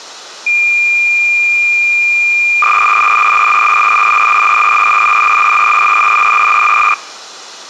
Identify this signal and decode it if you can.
Cassette data (Kansas City type), 300 baud, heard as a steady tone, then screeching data.